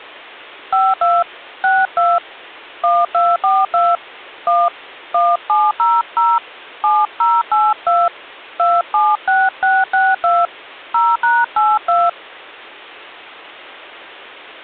DTMF, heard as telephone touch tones, dialled by hand, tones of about 220 ms. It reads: 52 62 1242 1 1700 7082 276662 0#82